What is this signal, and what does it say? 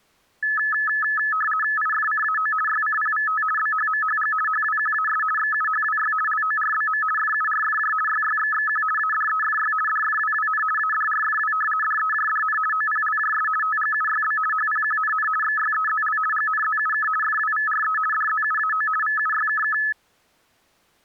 RTTY (50 baud, 450 Hz shift), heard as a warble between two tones, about 1500 Hz centre. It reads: IFCAO YCPVT BHMHG HWQAS XUHWY LORBM FURFJ YYXXQ ADEFY DFWWN ADRFW DEJDN OPLJS TGUYB HPQNN XYEZL GNZUK FWVRE DZUAO VUYKK